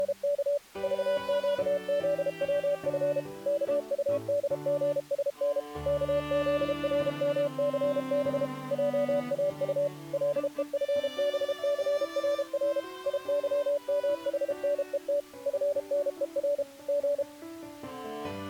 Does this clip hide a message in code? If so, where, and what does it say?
Yes: Morse code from 0.0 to 17.3 s, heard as a keyed tone, machine-sent, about 32 wpm, 580 Hz. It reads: … VQZWF KUDGSN KZRMCB JAU LEFBCRR IYMHNET FNER G